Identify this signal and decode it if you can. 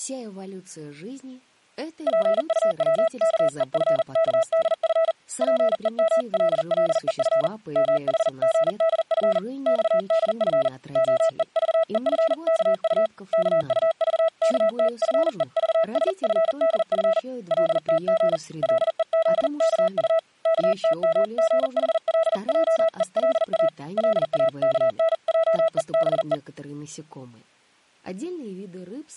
Morse code (Korean alphabet), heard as a keyed tone, hand-sent with a paddle, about 40 wpm, 650 Hz. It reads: 집안은 잠깐 무슨 큰 파란이 일어나려는 것 같이 엄숙하고 고요하다